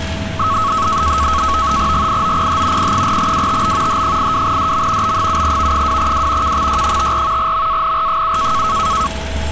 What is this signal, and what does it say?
NAVTEX (SITOR-B), 100 baud, 170 Hz shift, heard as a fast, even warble, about 1200 Hz centre, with a steady whistle near 650 Hz and street noise. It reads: GIOPH P4WTB H82DM B7V2W KXY54 MANR7